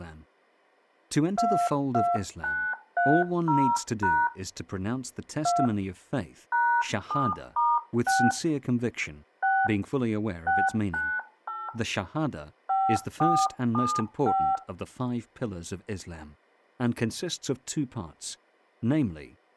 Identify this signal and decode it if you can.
DTMF, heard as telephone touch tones, dialled by hand, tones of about 250 ms, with speech in English. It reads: 22930# 2 #7*6 6 698 5475